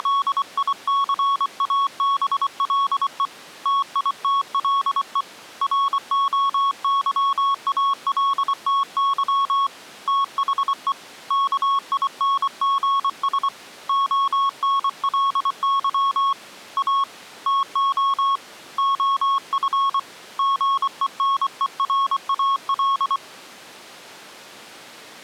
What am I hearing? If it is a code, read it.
Morse code, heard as a keyed tone, hand-sent with a paddle, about 24 wpm, 1100 Hz. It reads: … TITLE ROYALTY THE KINGS ONLY A TO OF GENERAL